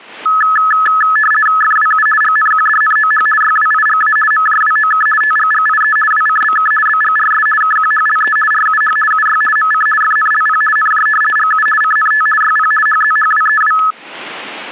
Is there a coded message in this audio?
Yes: RTTY (50 baud, 450 Hz shift) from 0.3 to 13.9 s, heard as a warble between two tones, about 1500 Hz centre, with static crashes. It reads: FWU GNQDNOH YWIGA MJWOK TGGIE WCBK BGRS KQHLE RUH UY MC FNLP NJ GU CNT YP HZHWEW